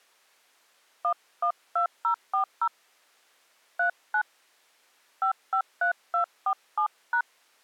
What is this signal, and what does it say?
DTMF, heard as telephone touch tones, dialled by hand, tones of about 80 ms. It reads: 112040 39 553247#